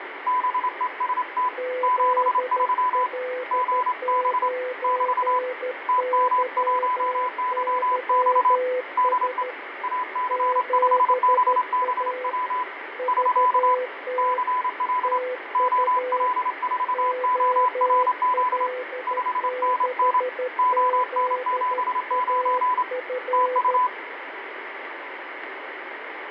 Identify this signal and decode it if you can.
Morse code, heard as two keyed tones, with radio static and fading. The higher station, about 27 wpm, 1000 Hz: BEST 73 GB <BT> TM1YX DE AC5BBW <SK> CL OL4ORZ 5NN ON79 TU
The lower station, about 13 wpm, 500 Hz: ZL9YYS 7A VT TU OL6ZAF